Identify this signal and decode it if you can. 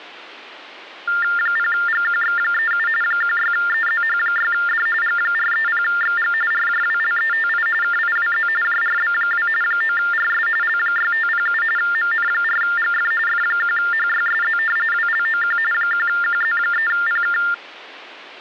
TTY/TDD text telephone tones (45.45 baud Baudot), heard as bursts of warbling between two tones, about 400 Hz shift, 1600 Hz centre. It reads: 0GQX37 16EZH6D G430XG RJWLETI KIWZ JRB2 9RS L6507 MN4GF F1HYSZ WLOQ 1QZ3PK